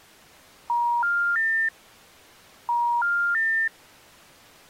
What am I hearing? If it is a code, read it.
Telephone call progress tone (ITU plan), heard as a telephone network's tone, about 950, 1400, 1800 Hz. Special information tone.